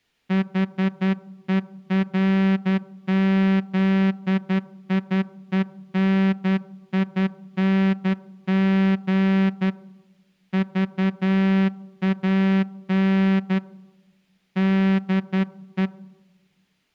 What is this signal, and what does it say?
Morse code, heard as a horn, hand-sent with a straight key, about 11 wpm. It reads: HERZIENING VAN DE